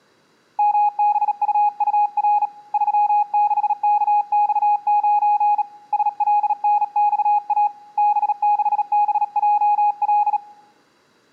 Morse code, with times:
0.6-2.5 MBUUR
2.7-5.6 36KX9
5.9-7.7 SLNXA
8.0-10.4 B6BJL

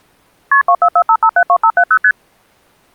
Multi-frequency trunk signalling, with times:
0.5-0.6 KP
0.7-2.0 2445572570
2.0-2.1 ST

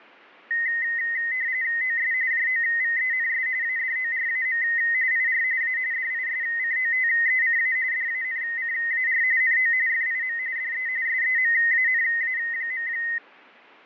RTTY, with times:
1.8-2.1 OS
2.3-3.5 JOVENS
3.6-4.6 ADORAM
5.1-5.4 IR
5.6-5.8 A
5.9-7.8 DISCOTECA
7.9-9.2 DANCAR
9.4-9.7 NO
9.9-10.4 FIM
10.6-10.9 DE
11.1-12.9 SEMANA.

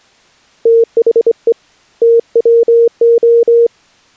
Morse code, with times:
0.7-1.5 THE
2.0-3.7 TWO

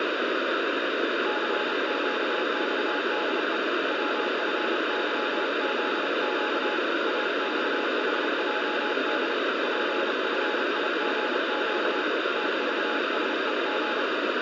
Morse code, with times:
1.3-3.6 CQXDE
3.9-6.8 WFYZQ
7.1-9.3 AXHJD
9.6-12.0 PFIGQ
12.4-14.0 TVSEG

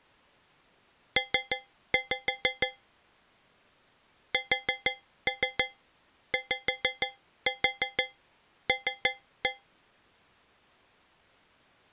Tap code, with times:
1.2-2.7 P
4.3-9.5 SYL

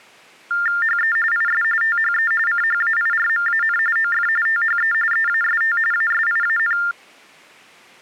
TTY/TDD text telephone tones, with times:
0.8-1.2 HE
1.3-1.6 IS
1.8-2.3 THE
2.5-3.8 CHAIRMAN
4.0-4.3 OF
4.5-4.9 THE
5.1-5.8 EAST
5.9-6.8 ASIAN

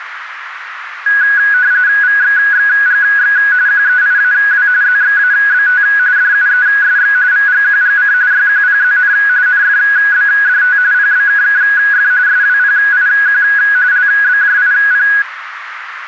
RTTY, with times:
2.0-3.4 VXXGX
3.7-4.7 QEIAW
4.8-5.8 ZXABT
6.2-7.2 DUESX
7.3-8.1 VGQGC
8.3-9.1 YQPZN
9.5-10.8 NFBDT
10.9-12.1 PBKKF
12.3-13.4 SWPIQ
13.9-15.1 LBJIP

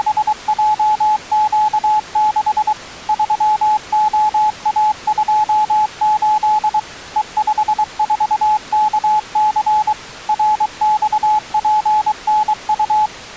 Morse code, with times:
0.0-2.7 …
3.1-6.8 3OA28
7.2-9.9 E54KC
10.3-13.1 RXPNU

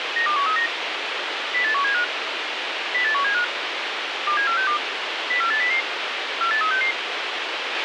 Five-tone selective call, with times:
0.2-0.7 92139
1.5-2.0 08175
2.9-3.4 08175
4.3-4.8 27462
5.3-5.8 04800
6.4-6.9 48366

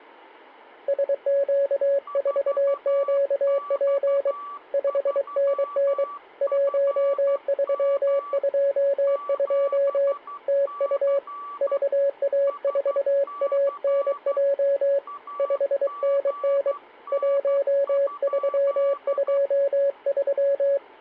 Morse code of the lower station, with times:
0.9-4.3 SQ4QP
4.7-6.0 5NN
6.4-10.1 1322
10.5-11.2 TU
11.6-15.0 VA4ANJ
15.4-16.7 5NN
17.1-20.8 1323

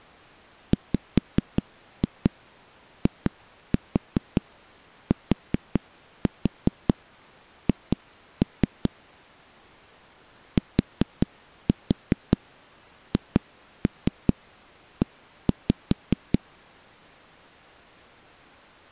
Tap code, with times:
0.7-8.9 WITH
10.6-16.4 THE

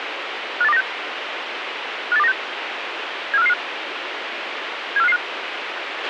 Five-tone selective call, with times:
0.6-0.8 58296
2.1-2.3 58296
3.3-3.5 74555
5.0-5.2 74555

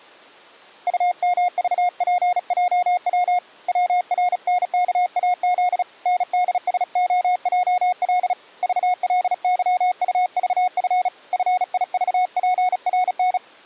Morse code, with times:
0.9-3.4 UMVPJW
3.7-5.8 WRNKAZ
6.1-8.3 NDSOJL
8.6-11.1 VLYUVF
11.3-13.4 FIVPRN

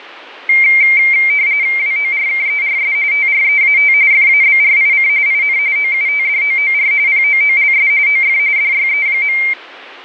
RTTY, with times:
1.8-2.9 WORKERS
3.1-3.9 TREAT
4.1-5.1 FABRIC
5.3-5.6 IN
5.8-6.9 OUTDOOR
7.1-7.9 POOLS
8.1-8.4 OF
8.6-9.4 DYE.

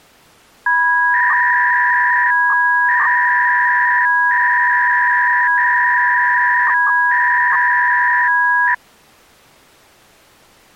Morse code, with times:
none

